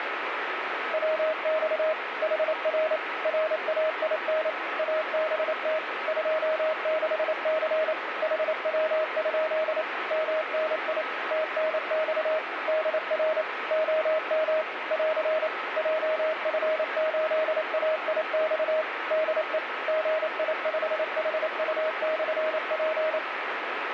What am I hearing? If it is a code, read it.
Morse code, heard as a keyed tone, machine-sent, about 28 wpm, 630 Hz, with radio static. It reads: WX HR RAIN ABT 26C HW? MNI TNX DR OM <AR> JF8AIX DE GI5HU/P